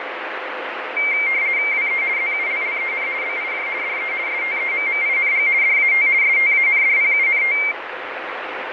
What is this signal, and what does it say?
RTTY (50 baud, 170 Hz shift), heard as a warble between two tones, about 2200 Hz centre, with radio static. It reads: WE ZULLEN BIJ DE STEMMING DAT STANDPUNT